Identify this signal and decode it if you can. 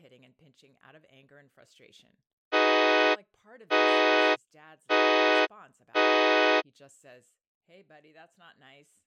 Train horn signal, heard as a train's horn, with speech in English. 4 short. On North American railways: a request for a signal to be given or repeated.